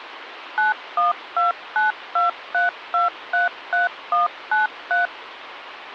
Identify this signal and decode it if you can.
DTMF, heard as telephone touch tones, dialled by machine, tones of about 140 ms, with phone line noise. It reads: 912923233193